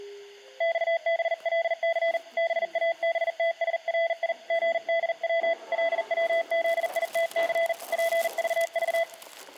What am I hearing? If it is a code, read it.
Morse code, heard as a keyed tone, hand-sent with a bug key, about 40 wpm, 670 Hz, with room echo and the noise inside a lift. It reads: XBLC BABTSRI GDW LWZITC PVV